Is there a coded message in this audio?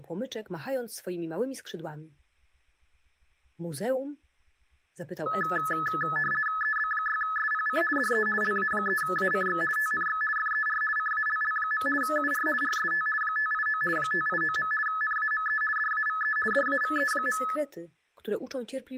Yes: RTTY (50 baud, 450 Hz shift) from 5.3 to 17.6 s, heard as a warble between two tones, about 1500 Hz centre. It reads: EB6SPC DE LA3ACX TNX FER CALL. UR RST 589 589. NAME DAVE DAVE.